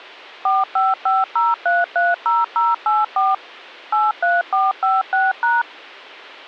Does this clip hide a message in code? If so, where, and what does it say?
Yes: DTMF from 0.5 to 5.6 s, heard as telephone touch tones, dialled by machine, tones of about 190 ms. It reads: 4550330084 83456#